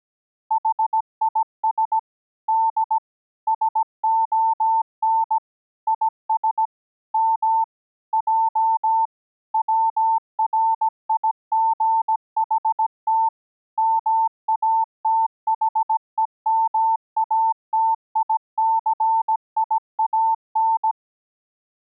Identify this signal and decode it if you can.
Morse code, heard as a keyed tone, machine-sent, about 17 wpm, 900 Hz. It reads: HIS D SON IS M J WRIGHT MATHEMATICIAN